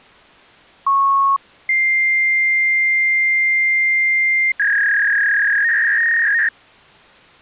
Fax machine handshake, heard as a beep, a long tone and a warble.